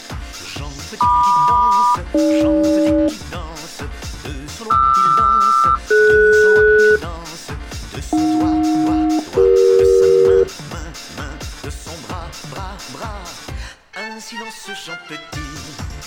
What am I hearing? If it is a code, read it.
Aircraft SELCAL, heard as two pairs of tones. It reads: MQ-AG QR-DS AJ-CE